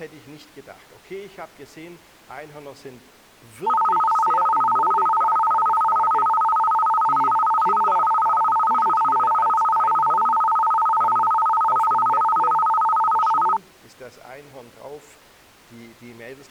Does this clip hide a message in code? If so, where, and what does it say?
No, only a tone that alternates evenly between two pitches.